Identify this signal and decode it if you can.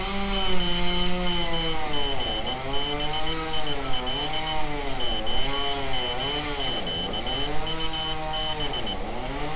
Morse code (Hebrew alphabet), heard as a high beeper, machine-sent, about 18 wpm, 3050 Hz, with street noise. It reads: המגביל המקטב